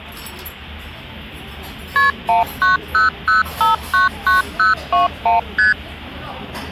Multi-frequency trunk signalling (R1, as on North American trunks), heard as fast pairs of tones, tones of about 140 ms, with the noise of a restaurant. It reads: KP 1900599021 ST